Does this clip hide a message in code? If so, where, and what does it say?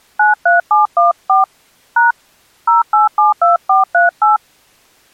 Yes: DTMF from 0.2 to 4.4 s, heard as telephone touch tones, dialled by hand, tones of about 150 ms. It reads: 93714 # 0872438